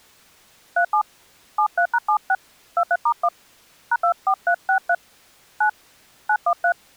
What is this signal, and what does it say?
DTMF, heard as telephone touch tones, dialled by hand, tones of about 70 ms. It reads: 37 73#76 23*1 #24363 9 913